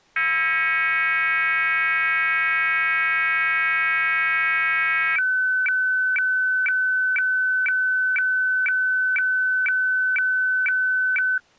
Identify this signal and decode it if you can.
Weather fax (radiofax), 120 lines a minute, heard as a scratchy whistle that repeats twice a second.